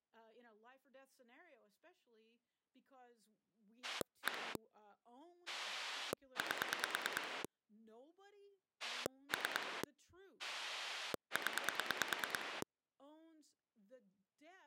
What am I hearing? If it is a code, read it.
Pulse dialling, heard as a rotary dial, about 9 pulses a second, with speech in English. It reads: 1 8 3 0